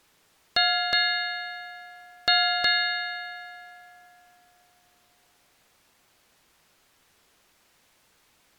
Ship's bell, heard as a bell. 4. Four half-hours of the watch have passed.